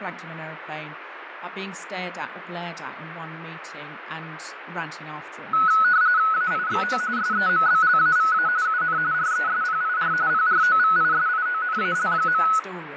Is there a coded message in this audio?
Yes: RTTY (45.45 baud, 170 Hz shift) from 5.5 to 12.6 s, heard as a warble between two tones, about 1380 Hz centre, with radio static, fading and speech in English. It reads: AIXO SEMBLAVA UN RESPIR PROVISIONAL.